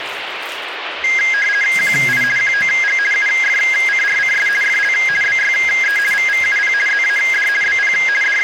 RTTY (50 baud, 450 Hz shift), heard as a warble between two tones, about 1850 Hz centre, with radio static and the noise of a restroom. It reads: QI QOG UFCRCS FL BYE VVUP ZAD BP …